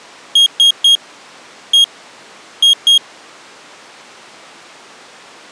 Beep code, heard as a piezo beeper, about 3250 Hz. 3-1-2. In Phoenix BIOS tables: DMA register failure.